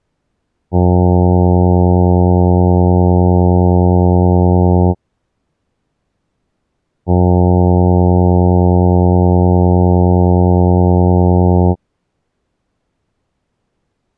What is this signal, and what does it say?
Ship horn signal, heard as a ship's horn, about 90 Hz. 2 long. At sea: a vessel under power that has stopped in fog.